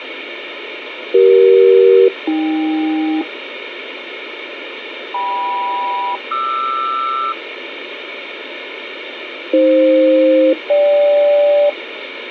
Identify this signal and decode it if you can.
Aircraft SELCAL, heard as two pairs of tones, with radio hiss. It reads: CE-AK KM-QR AF-GK